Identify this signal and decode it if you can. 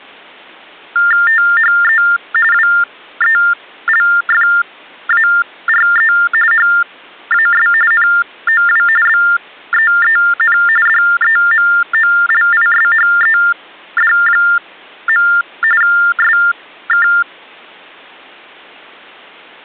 TTY/TDD text telephone tones (45.45 baud Baudot), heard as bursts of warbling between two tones, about 400 Hz shift, 1600 Hz centre. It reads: THE WELFARE HAS NOW BEEN DEMOLISHED. SK